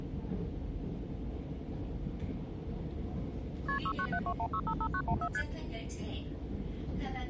Multi-frequency trunk signalling (R1, as on North American trunks), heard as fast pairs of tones, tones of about 70 ms, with the noise inside a subway train. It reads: KP 69721655914 ST